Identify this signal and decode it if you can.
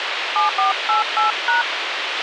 DTMF, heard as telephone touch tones, dialled by hand, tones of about 140 ms, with radio hiss and a squelch burst at the end. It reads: 7488#